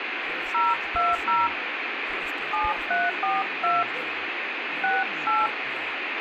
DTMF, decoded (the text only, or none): 020 7342 68